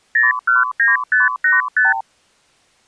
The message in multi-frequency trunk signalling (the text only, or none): 019585